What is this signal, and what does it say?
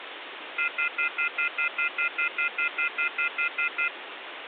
Telephone call progress tone (North American plan), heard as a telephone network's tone, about 1400, 2050, 2450, 2600 Hz, 0.1 s on and 0.1 s off, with phone line noise. Off-hook warning tone.